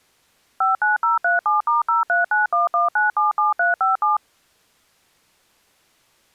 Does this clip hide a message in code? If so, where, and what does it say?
Yes: DTMF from 0.6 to 4.2 s, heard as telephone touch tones, dialled by machine, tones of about 150 ms. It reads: 59037*03911977357